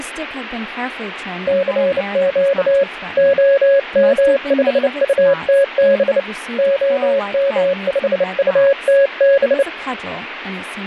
Morse code, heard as a keyed tone, hand-sent with a bug key, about 29 wpm, 550 Hz, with speech in English. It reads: CQ OM5UTB OM5UTB